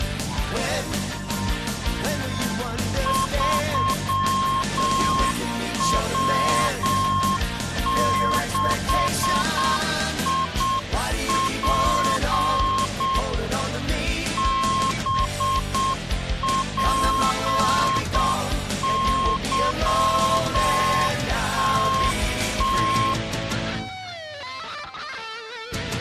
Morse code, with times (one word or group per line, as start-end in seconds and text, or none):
3.1-13.2 3W6IP
14.4-23.1 BPYTT